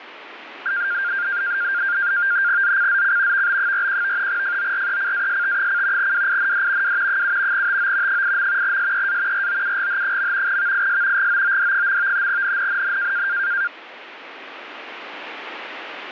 NAVTEX (SITOR-B), 100 baud, 170 Hz shift, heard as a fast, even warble, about 1500 Hz centre, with radio static. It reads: ZCZC VB41 FORECAST: WIND W 7 TO 8. SEA ROUGH. VIS GOOD. NNNN